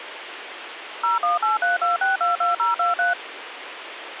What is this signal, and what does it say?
DTMF, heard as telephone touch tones, dialled by machine, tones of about 150 ms, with phone line noise. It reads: 01832622023